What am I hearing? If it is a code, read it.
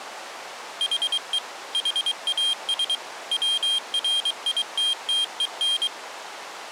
Morse code, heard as a high beeper, machine-sent, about 23 wpm, 3200 Hz. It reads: HE HAS WRITTEN